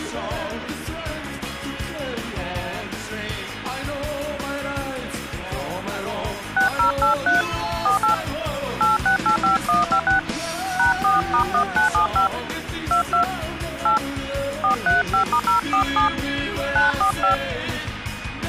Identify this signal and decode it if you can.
DTMF, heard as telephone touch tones, dialled by hand, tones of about 120 ms, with phone line noise. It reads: 6083 48 8685156 #4*1975 22 8 435*047 945